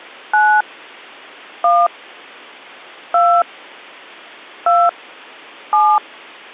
DTMF, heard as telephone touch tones, dialled by hand, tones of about 260 ms. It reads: 9 1 2 2 7